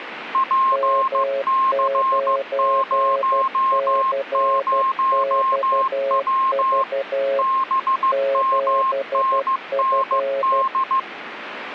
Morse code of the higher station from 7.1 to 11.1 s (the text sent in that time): BMNND